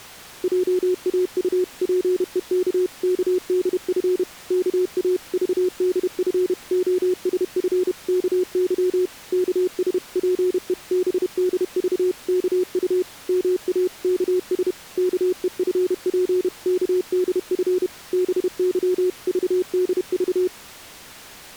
Morse code (Korean alphabet), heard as a keyed tone, machine-sent, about 31 wpm, 360 Hz. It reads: 회장은 오른편에 여자들이 모여 앉은 데를